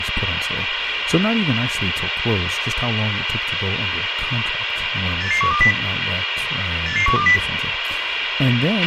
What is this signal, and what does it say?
Five-tone selective call (CCIR), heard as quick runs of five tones, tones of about 100 ms, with radio hiss, a squelch burst at the end and speech in English. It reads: 88120 88120